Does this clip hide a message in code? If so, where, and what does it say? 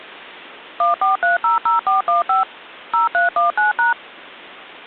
Yes: DTMF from 0.8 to 3.9 s, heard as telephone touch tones, dialled by machine, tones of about 140 ms. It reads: 14300415 0319#